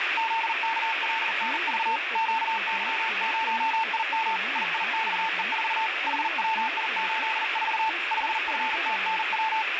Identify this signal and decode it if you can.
Morse code, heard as a keyed tone, hand-sent with a paddle, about 40 wpm, 890 Hz, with radio static and speech in Gujarati. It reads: ZKLNV QY0IM IIXE4 HWI84 5FTNW